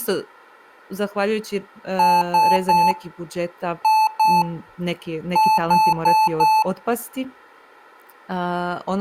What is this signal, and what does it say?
Beep code, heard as beeps from a small speaker, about 870 Hz, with room echo and speech in Croatian. 3-2-4. In Phoenix BIOS tables: keyboard controller failure.